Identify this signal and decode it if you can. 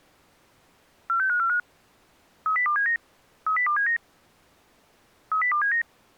Five-tone selective call (CCIR), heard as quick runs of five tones, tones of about 100 ms. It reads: 46545 30279 30279 30279